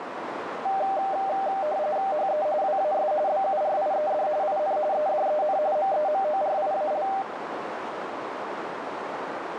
RTTY (45.45 baud, 170 Hz shift), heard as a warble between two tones, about 690 Hz centre, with radio static and a narrow filter. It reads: HE WAS BURIED IN EDEN MEMORIAL